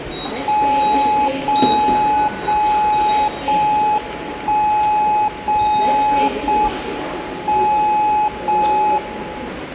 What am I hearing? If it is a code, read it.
Radio time signal (JJY), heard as a tone whose level steps once a second, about 850 Hz, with the noise of a subway station. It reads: 0 0 0 1 0 0 M 0 1